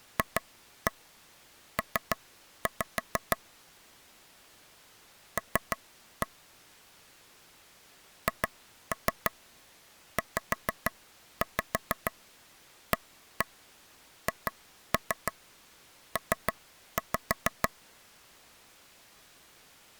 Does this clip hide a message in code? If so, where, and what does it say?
Yes: tap code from 0.2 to 17.7 s, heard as taps on a table, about 6 knocks a second. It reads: FP L HZAHP